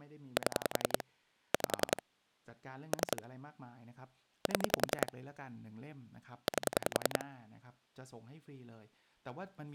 Pulse dialling, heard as clicks on a phone line, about 10 pulses a second, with speech in Thai. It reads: 7 5 3 7 8